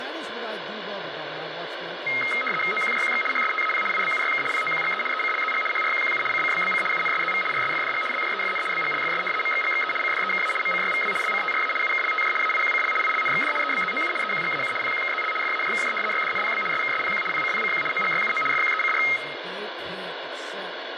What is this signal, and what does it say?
RTTY (75 baud, 850 Hz shift), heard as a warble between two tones, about 1700 Hz centre, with radio static and speech in English. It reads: OQJQX HSTAP IBUYK POQGE ECLZG HRQQU CCBBC UNSZV RSFDG LJEFN BGLFS MXGXE CDEKA MCYVW LCTRA UKLTJ AIQCL ILNXD EBZOU EQGAU PQKZL FAJKJ YDNPB SKSPQ PCPCQ OGYUO FQECR